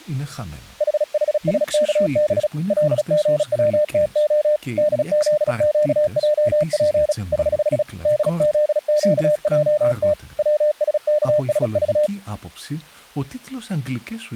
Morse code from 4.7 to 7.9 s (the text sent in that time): DZQJP <HH>